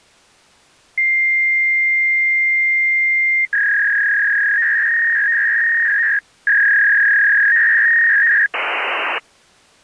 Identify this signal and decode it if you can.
Fax machine handshake, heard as a long tone, a warble and hiss.